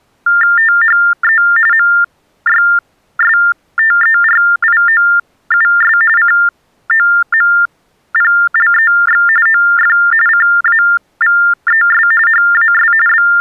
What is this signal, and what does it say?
TTY/TDD text telephone tones (45.45 baud Baudot), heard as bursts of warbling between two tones, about 400 Hz shift, 1600 Hz centre. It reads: THE MYSTERIOUS COMPLEX OF CAVES HAS …